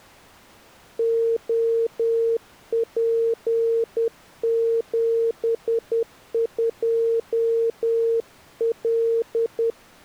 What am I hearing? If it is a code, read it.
Morse code, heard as a keyed tone, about 10 wpm, 460 Hz. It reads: OP72L